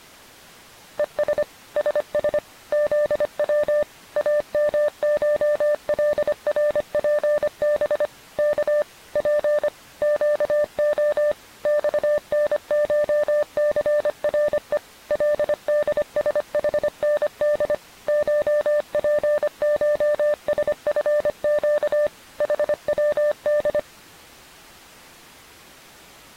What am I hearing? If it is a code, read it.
Morse code (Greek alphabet), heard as a keyed tone, machine-sent, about 25 wpm, 590 Hz. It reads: ΕΣ ΣΣ ΖΩ ΑΜΧΛΡΠΒ Κ Π ΨΟ ΞΝΧΘΡΕ ΛΔΣΗΝΔ ΧΠΧΣΦΨ ΗΩΔ